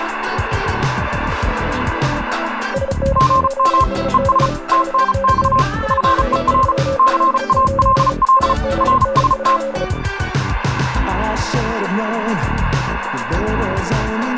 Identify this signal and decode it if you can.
Morse code, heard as two keyed tones, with radio static and room echo. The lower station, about 35 wpm, 540 Hz: SN8SK 5NN 1369 AGN?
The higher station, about 35 wpm, 1050 Hz: GM ES TNX FER CALL RST